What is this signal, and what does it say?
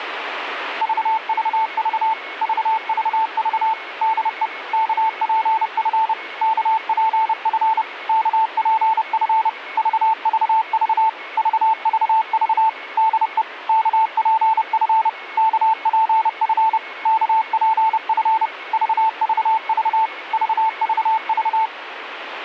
Morse code, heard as a keyed tone, machine-sent, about 30 wpm, 890 Hz, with radio static and a weaker station near 2190 Hz. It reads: VVV VVV DE KPF KPF KPF VVV VVV DE KPF KPF KPF VVV VVV